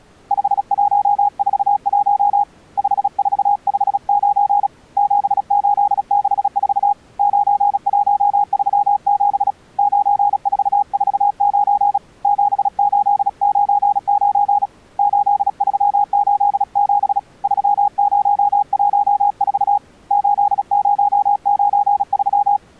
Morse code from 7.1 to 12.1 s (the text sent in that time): 9137 9449